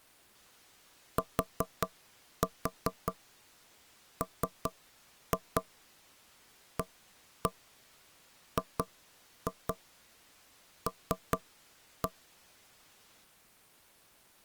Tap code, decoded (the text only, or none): TMAGL